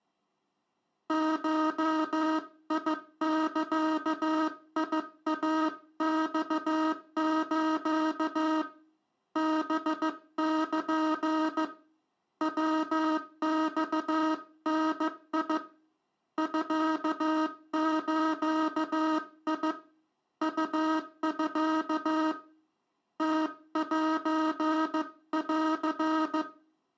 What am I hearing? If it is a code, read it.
Morse code (Japanese Wabun code), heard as a buzzer, hand-sent with a paddle, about 15 wpm, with room echo. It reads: ゴザイマス ハル ヤマダ ミズ ウミ ムセン